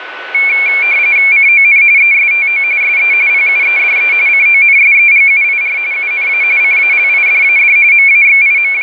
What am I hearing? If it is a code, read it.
RTTY (45.45 baud, 170 Hz shift), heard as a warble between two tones, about 2300 Hz centre, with radio static and a steady whistle near 1490 Hz. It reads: CON ESTO SE PUEDE CONSEGUIR UNA CALIDAD …